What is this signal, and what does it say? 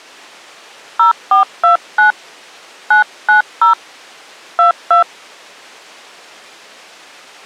DTMF, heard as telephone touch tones, dialled by hand, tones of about 120 ms. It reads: 0429 990 22